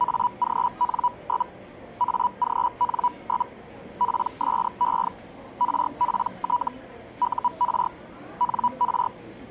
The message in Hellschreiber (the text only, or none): AGN? AGN? PSE RPT UR NR